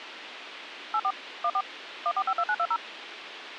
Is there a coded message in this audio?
Yes: DTMF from 0.9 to 2.8 s, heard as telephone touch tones, dialled by machine, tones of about 60 ms, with radio hiss. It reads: 84 14 1452920